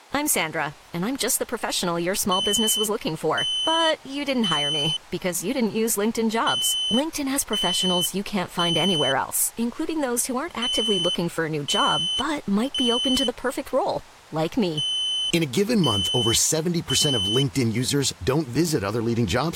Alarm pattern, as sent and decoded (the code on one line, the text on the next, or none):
3 beeps and a pause
temporal three